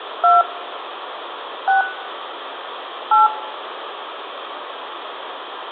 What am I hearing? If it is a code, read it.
DTMF, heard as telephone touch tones, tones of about 170 ms, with phone line noise and room echo. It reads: 2 6 8